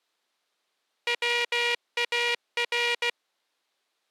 Morse code, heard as a buzzer, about 16 wpm. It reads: WAR